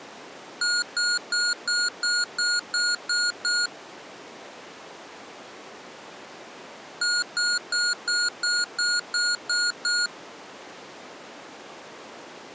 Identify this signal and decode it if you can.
Beep code, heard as beeps from a small speaker, played twice, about 1440 Hz. 9 short. In AMI BIOS tables: ROM checksum failure.